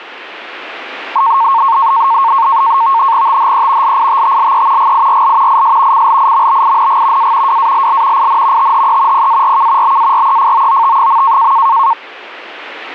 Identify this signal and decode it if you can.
NAVTEX (SITOR-B), 100 baud, 170 Hz shift, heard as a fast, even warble, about 1000 Hz centre. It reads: THE LITTLE GIRL IS CLIMBING A WALL IN THE PARK BAREFOOT.